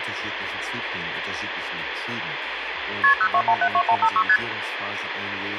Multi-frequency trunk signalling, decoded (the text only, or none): KP 02172156 ST